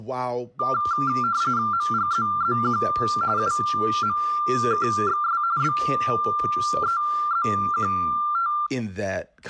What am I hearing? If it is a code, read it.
RTTY (45.45 baud, 170 Hz shift), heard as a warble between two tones, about 1280 Hz centre, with speech in English. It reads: MGZZQ UMKXS BEZQT